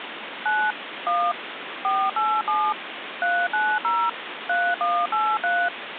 DTMF, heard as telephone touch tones, dialled by machine, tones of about 250 ms, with phone line noise. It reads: 9 1 487 390 3183